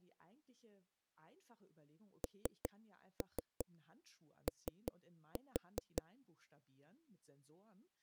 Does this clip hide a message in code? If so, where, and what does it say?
Yes: tap code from 2.2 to 6.0 s, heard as knocks on a wall, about 5 knocks a second, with speech in German. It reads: NO